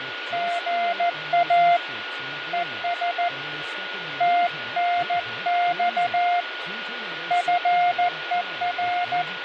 Morse code, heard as a keyed tone, hand-sent with a paddle, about 14 wpm, 700 Hz, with radio static, fading, a steady whistle near 1440 Hz and speech in English. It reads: GA ES TNX FER